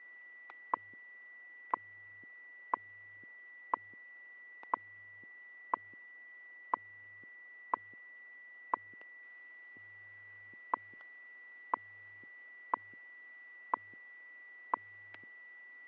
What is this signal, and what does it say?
Radio time signal (WWV, Colorado), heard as ticks, one a second, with static crashes and a steady whistle near 1960 Hz.